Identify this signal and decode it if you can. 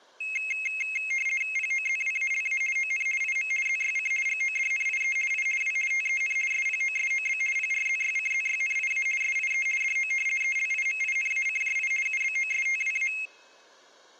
RTTY (50 baud, 450 Hz shift), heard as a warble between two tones, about 2350 Hz centre. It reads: POZWALA ON IM ZYC GODNIE I W TEN SPOSOB PRZYCZYNIA SIE DO ELIMINACJI UBOSTWA